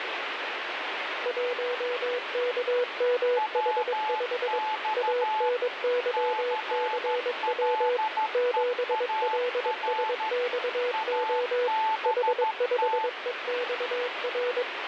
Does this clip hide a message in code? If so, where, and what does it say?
Yes: Morse code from 1.2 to 14.7 s, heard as two keyed tones, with radio static. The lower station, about 22 wpm, 490 Hz: 1KMH5 ANYCW 7LSXO H5EXR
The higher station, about 13 wpm, 870 Hz: WX CLEAR ABT